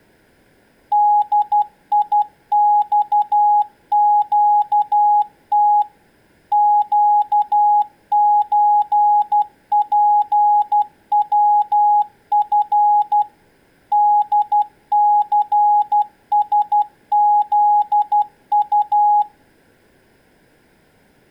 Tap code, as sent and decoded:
none

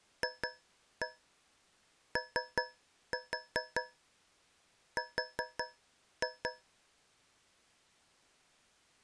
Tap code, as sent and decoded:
2-1 3-4 4-2
FOR

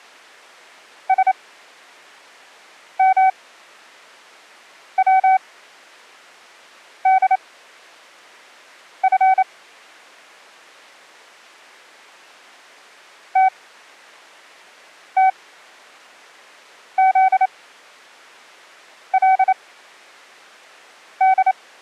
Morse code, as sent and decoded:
... -- .-- -.. ..-. / - - --.. .-.. -..
SMWDF TTZLD

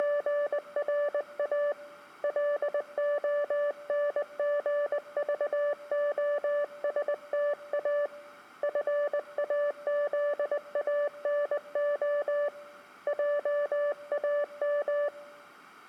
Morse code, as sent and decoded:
… / .-.. --- -. --. ...- --- ... - .- / ..-. .- --.. .- -. --- / .--- .- --
… LONGVOSTA FAZANO JAM

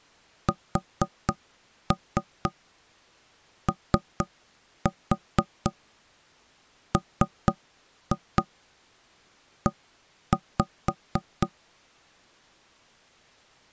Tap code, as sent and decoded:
4-3 3-4 3-2 1-5
SOME

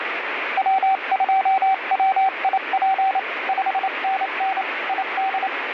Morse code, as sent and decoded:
.-- ..--- .-- .. .--. / ..... -. -. / .. -..
W2WIP 5NN ID

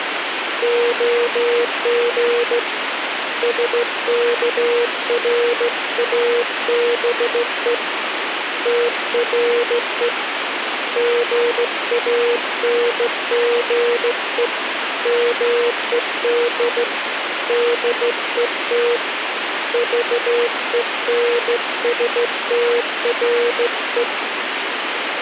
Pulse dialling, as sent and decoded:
none

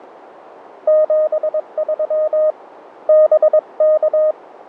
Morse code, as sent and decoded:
--... ...-- / -... -.-
73 BK

